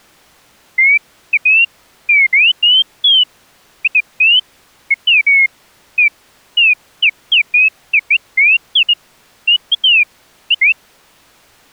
Bird-like chirps. There is no code.